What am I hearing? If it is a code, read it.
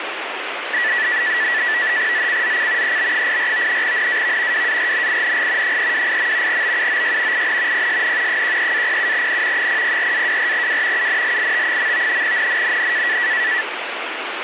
NAVTEX (SITOR-B), 100 baud, 170 Hz shift, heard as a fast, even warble, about 1850 Hz centre, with radio static. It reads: ZCZC EB84 NAV WARNING 328. BUOY IN PSN 13-07N 004-24W UNLIT. NNNN